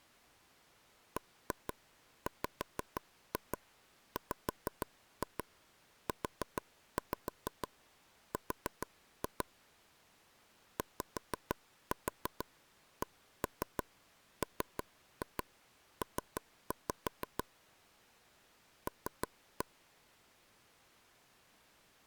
Tap code, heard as taps on a table, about 6 knocks a second. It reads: BWWUR YCMP L